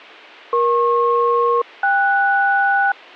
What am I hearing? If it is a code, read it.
Aircraft SELCAL, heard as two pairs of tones. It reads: EP-KS